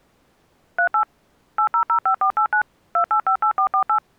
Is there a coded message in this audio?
Yes: DTMF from 0.8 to 4.0 s, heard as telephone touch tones, dialled by machine, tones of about 90 ms. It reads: 38 8005489 2858448